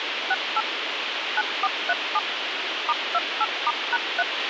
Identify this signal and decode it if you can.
DTMF, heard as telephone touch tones, dialled by machine, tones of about 40 ms, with radio hiss and a squelch burst at the end. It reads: 68 9437 *28*#3